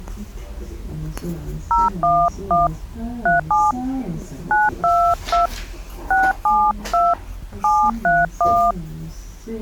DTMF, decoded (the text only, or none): 011 37 922 672 731